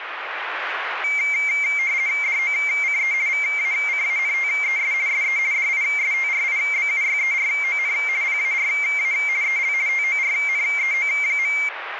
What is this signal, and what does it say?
RTTY (50 baud, 170 Hz shift), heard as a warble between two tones, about 2200 Hz centre, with radio static. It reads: DOCE VACANTES SE DISTRIBUYERON PARA EL TORNEO.